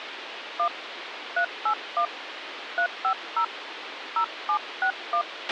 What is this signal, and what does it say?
DTMF, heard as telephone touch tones, dialled by hand, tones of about 80 ms, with radio hiss and a squelch burst at the end. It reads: 1 381 350 0761